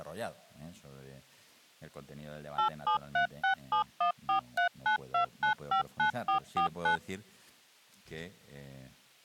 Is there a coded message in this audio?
Yes: DTMF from 2.6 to 7.0 s, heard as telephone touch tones, dialled by machine, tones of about 110 ms. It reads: 8736714392959449